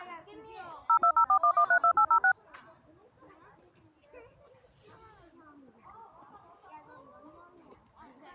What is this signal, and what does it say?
DTMF, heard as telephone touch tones, dialled by machine, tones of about 80 ms, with the noise of a residential street. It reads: 02041132806